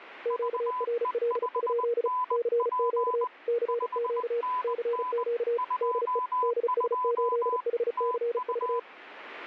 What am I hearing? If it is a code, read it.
Morse code, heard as two keyed tones, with radio static. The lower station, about 35 wpm, 470 Hz: QRL? CQ CQ CQ DE DS8HCV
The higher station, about 20 wpm, 1000 Hz: VE5NP 5NN 22 TU